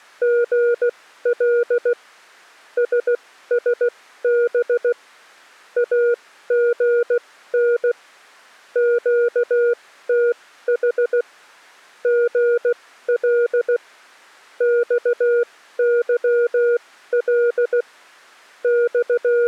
Morse code, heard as a keyed tone, machine-sent, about 16 wpm, spaced as for 13 wpm, 480 Hz. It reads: GL SSB AGN QTH GL XYL …